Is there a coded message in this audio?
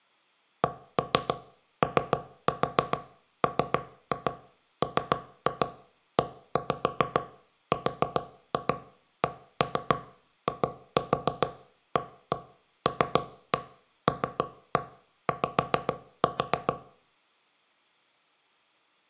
Yes: tap code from 0.6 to 16.7 s, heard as knocks on wood, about 7 knocks a second, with room echo. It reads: COMMERCIALLY